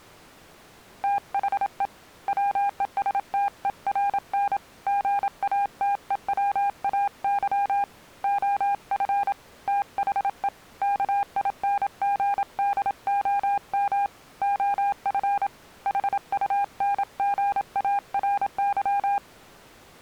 Morse code, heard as a keyed tone, hand-sent with a paddle, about 27 wpm, 800 Hz. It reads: THE WESTERN GATEWAY OF THE KINGDOM OF HUNGARY